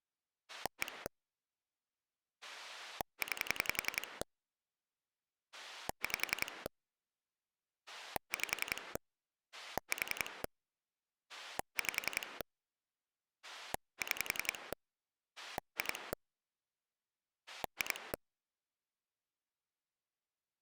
Pulse dialling, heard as a rotary dial, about 11 pulses a second. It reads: 1 9 5 5 4 5 6 2 2